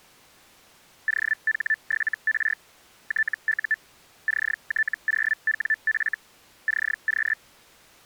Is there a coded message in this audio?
Yes: Hellschreiber (Feld-Hell, 122.5 baud) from 1.1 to 7.3 s, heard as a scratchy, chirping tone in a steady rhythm, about 1750 Hz. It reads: OH7R TU CT0WF CQ